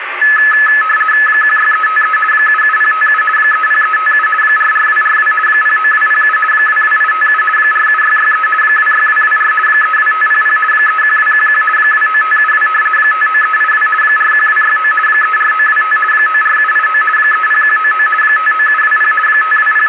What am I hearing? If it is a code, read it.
RTTY (50 baud, 450 Hz shift), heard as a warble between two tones, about 1500 Hz centre, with radio static. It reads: 16353 77057 30357 44242 09207 22857 47663 26224 32500 31211 29572 59382 41269 34925 94789 30199 59720 …